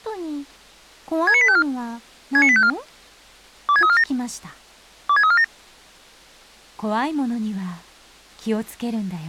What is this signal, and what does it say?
Five-tone selective call (ZVEI), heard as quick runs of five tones, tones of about 70 ms. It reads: 69854 69854 26347 26347